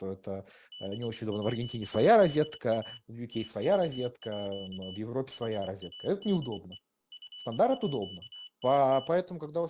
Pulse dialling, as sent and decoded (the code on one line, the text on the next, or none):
none